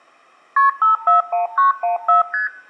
Multi-frequency trunk signalling (R1, as on North American trunks), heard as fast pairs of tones, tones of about 130 ms. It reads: KP 541914 ST